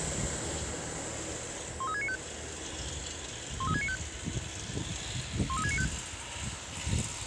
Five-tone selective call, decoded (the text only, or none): 13695 13695 13695